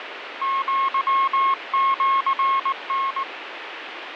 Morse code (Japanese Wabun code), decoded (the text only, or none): アシタ